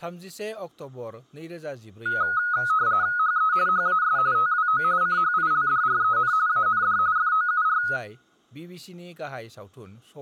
RTTY (45.45 baud, 170 Hz shift), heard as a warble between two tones, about 1360 Hz centre, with speech in Bodo. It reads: HE HAS TWO CHILDREN AND FOUR